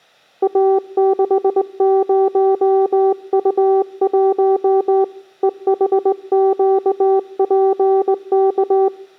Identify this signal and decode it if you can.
Morse code, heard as a keyed tone, hand-sent with a straight key, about 20 wpm, 390 Hz. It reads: A60U1 EHQPK